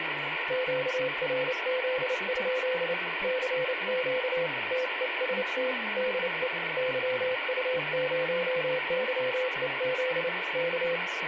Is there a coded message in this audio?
Yes: Morse code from 0.4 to 11.0 s, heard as a keyed tone, hand-sent with a paddle, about 29 wpm, 510 Hz, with radio static and speech in English. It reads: QRZ? CQ TEST DE YU0YEZ K